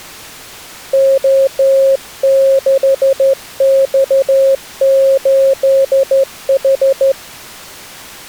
Morse code, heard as a keyed tone, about 13 wpm, 540 Hz. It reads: O6X8H